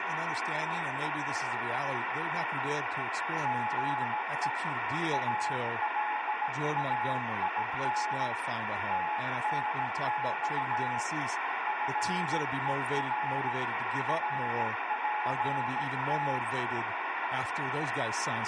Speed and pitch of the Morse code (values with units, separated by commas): 17 wpm, 850 Hz